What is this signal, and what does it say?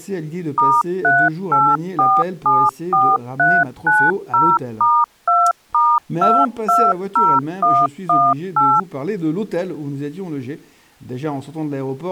DTMF, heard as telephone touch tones, dialled by machine, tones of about 240 ms. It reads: *38474390*2*220118